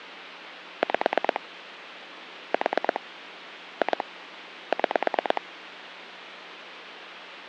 Pulse dialling, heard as clicks on a phone line, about 9 pulses a second, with phone line noise. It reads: 5 4 2 6